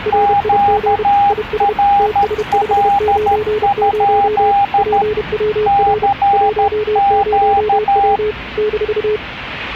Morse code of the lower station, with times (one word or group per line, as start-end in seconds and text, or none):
0.1-1.0 RIG
1.3-1.7 IS
2.0-4.5 TS590
4.8-6.1 PWR
6.3-8.3 10W
8.6-9.2 -